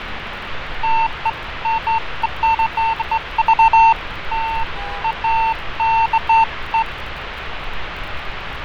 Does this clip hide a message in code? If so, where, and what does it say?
No, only beeps of irregular length, with radio static, fading and street noise.